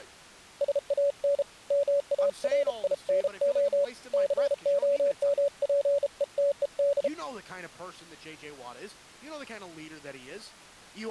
Morse code, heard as a keyed tone, hand-sent with a bug key, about 33 wpm, 570 Hz, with speech in English. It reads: SAN MARINO COMPETED